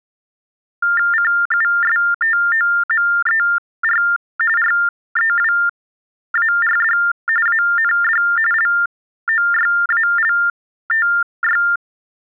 TTY/TDD text telephone tones (45.45 baud Baudot), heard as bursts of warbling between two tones, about 400 Hz shift, 1600 Hz centre. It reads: CUSTOMER REWARD AND LOYALTY